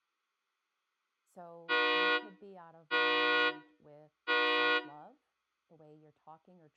Train horn signal, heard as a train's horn, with room echo and speech in English. 3 short. On North American railways: when stopped, the train will back up.